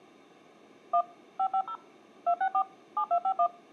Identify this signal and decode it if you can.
DTMF, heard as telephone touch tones, dialled by machine, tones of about 80 ms. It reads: 1 550 264 7251